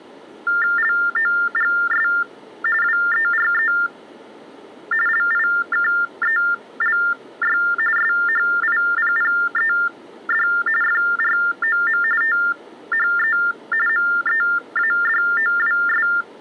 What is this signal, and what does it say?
TTY/TDD text telephone tones (45.45 baud Baudot), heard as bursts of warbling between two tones, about 400 Hz shift, 1600 Hz centre. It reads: LOGS WERE LIKELY SHIPPED FROM THE MEADOWS